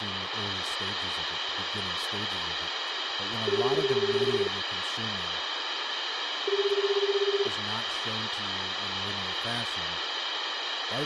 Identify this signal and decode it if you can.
Telephone call progress tone (Japanese plan), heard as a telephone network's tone, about 380, 400, 420 Hz, 1 s on and 2 s off, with phone line noise, room echo and speech in English. Ringback tone.